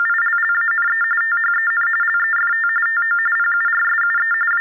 TTY/TDD text telephone tones (45.45 baud Baudot), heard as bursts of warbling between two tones, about 400 Hz shift, 1600 Hz centre. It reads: … THEN LEFT TO PURSUE …